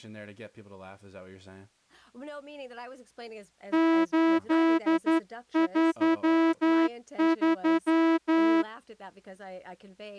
Morse code, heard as a horn, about 11 wpm, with speech in English. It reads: 833